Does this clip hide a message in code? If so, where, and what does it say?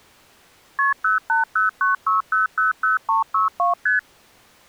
Yes: multi-frequency trunk signalling (R1, as on North American trunks) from 0.8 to 4.0 s, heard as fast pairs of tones, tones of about 140 ms. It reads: KP 08096000362 ST